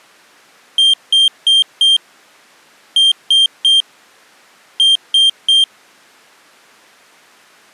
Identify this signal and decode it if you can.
Beep code, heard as a piezo beeper, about 3200 Hz. 4-3-3. In Phoenix BIOS tables: timer channel 2 failure.